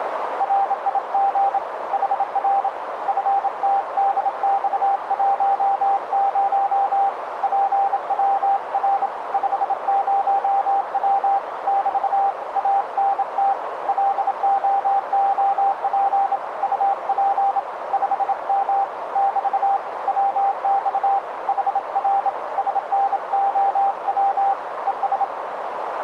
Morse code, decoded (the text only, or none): RIG HR FTDX10 PWR 50W <BT> ANT LOOP UP 5M <BT> WX HR SNOW ES